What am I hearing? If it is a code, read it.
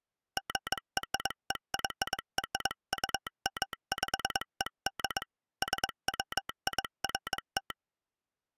Morse code (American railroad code), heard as a telegraph sounder, hand-sent with a straight key. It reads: GREYRUMPED SWIFT